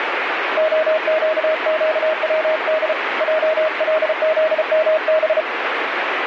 Morse code, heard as a keyed tone, hand-sent with a paddle, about 34 wpm, 630 Hz, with radio static. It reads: OQQWD JLZMB